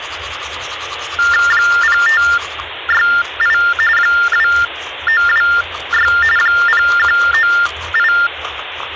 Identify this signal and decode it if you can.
TTY/TDD text telephone tones (45.45 baud Baudot), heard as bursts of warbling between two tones, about 400 Hz shift, 1600 Hz centre, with phone line noise and the noise of a restroom. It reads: 0568 2926 0198